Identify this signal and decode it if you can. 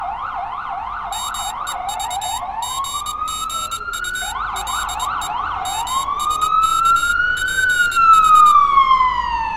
Morse code (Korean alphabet), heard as a high beeper, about 22 wpm, 3750 Hz, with street noise. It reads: 말씨가 명주